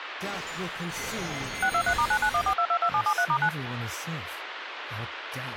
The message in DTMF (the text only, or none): 623*9914222773*9